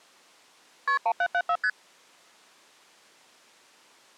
Multi-frequency trunk signalling (R1, as on North American trunks), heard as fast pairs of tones, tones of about 60 ms. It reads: KP 1774 ST